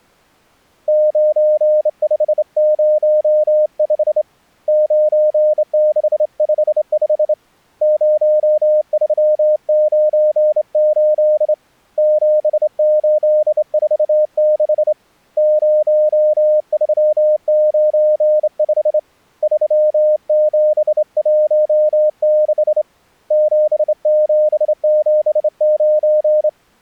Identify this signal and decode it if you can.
Morse code, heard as a keyed tone, hand-sent with a straight key, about 27 wpm, 610 Hz. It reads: 9505 9655 0398 7846 0395 3716 7779